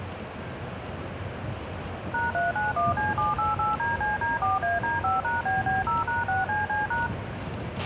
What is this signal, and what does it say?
DTMF, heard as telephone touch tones, dialled by machine, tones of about 160 ms, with a squelch burst at the end and the noise inside a bus. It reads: #391C788DCD4AD5#BB0#6CC#